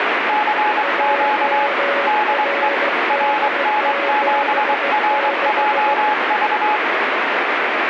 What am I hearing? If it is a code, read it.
Morse code, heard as two keyed tones, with radio static. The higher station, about 23 wpm, 850 Hz: CQ DE RN7RJV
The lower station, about 16 wpm, 560 Hz: JRD76